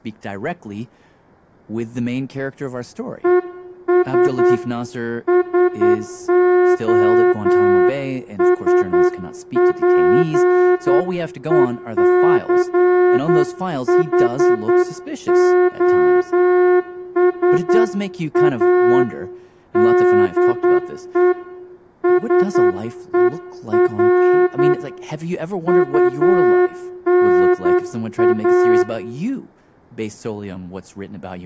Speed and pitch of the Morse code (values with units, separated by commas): 9 wpm